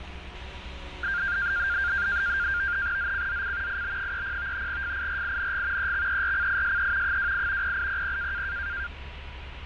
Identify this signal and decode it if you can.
NAVTEX (SITOR-B), 100 baud, 170 Hz shift, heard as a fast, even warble, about 1500 Hz centre, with radio static, a steady whistle near 970 Hz and street noise. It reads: ZCZC IB30 FIRING EXERCISE 28 0800